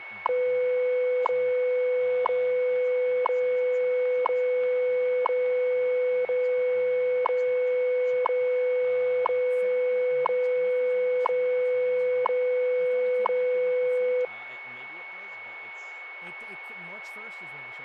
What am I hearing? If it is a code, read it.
Radio time signal (WWV, Colorado), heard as ticks, one a second, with a steady whistle near 2210 Hz and speech in English.